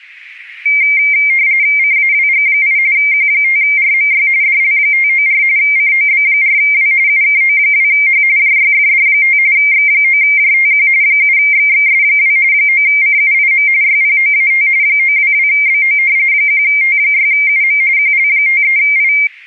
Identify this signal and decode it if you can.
RTTY (45.45 baud, 170 Hz shift), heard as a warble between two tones, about 2200 Hz centre. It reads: CAWG8 Q5RMY DL594 COB4W UKO2H JYFD5 X9JTQ 7XXS2 9CUIM YPOAT 922BO 1T6UM QL53I